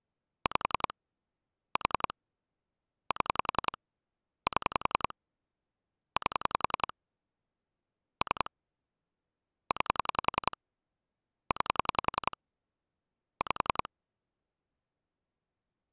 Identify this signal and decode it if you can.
Pulse dialling, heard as clicks on a phone line, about 10 pulses a second. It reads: 5 4 7 7 8 3 9 9 5